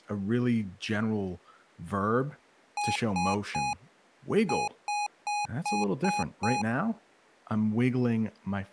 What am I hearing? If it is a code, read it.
Beep code, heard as beeps from a small speaker, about 830 Hz, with speech in English. 3-6.